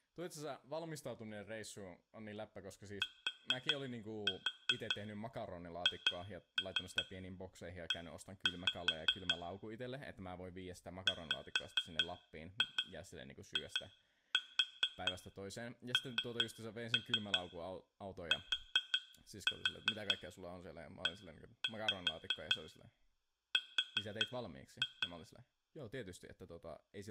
Tap code, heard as taps on glass, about 5 knocks a second, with room echo and speech in Finnish. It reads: THE WINTER